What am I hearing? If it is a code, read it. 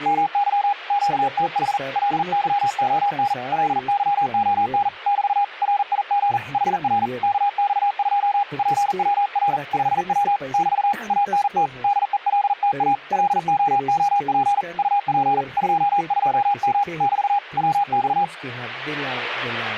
Morse code, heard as a keyed tone, hand-sent with a paddle, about 40 wpm, 810 Hz, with radio static and speech in Spanish. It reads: MY QTH LYON LYON <BT> RIG HR KX2 PWR 5W <BT> ANT DELTA LOOP UP 22M <BT> WX